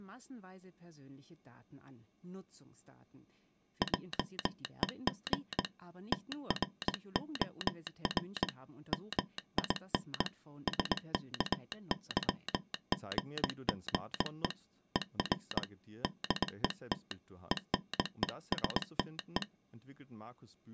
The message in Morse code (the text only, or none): JEG TROR MIN SKYGGE ER DET ENESTE